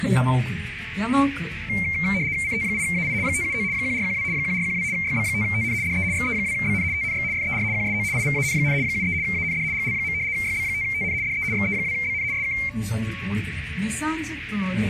RTTY (75 baud, 170 Hz shift), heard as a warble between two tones, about 2200 Hz centre. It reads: CT8AI 579 1412 1412 YB5TN DE XE2BN TNX FER QSO IVAN, 73 AND GL. YB5TN DE XE2BN SK